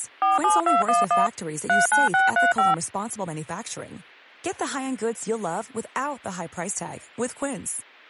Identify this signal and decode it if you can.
DTMF, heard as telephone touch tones, dialled by machine, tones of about 160 ms, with speech in English. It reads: 47211 39635